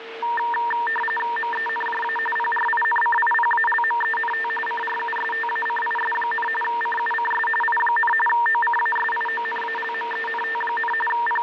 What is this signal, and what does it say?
RTTY (45.45 baud, 850 Hz shift), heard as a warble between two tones, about 1370 Hz centre, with radio static and a steady whistle near 460 Hz. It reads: MENJA PRINCIPALMENT CRUSTACIS, CUCS I, OCASIONALMENT, …